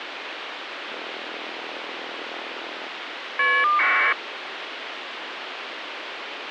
Caller ID data burst, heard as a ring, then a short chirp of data, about 1200 baud, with phone line noise.